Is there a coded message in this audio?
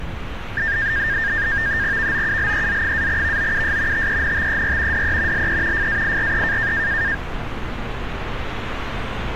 Yes: NAVTEX (SITOR-B), 100 baud, 170 Hz shift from 0.6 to 7.1 s, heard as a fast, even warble, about 1700 Hz centre, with street noise. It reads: VOULEZ-VOUS TENTER DE LE FAIRE